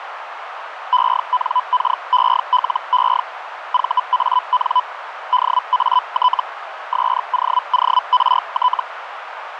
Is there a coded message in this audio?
Yes: Hellschreiber (Feld-Hell, 122.5 baud) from 0.9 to 8.8 s, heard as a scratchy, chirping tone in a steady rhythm, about 1000 Hz, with radio static and a narrow filter. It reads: ENKELE VAN DAT SOORT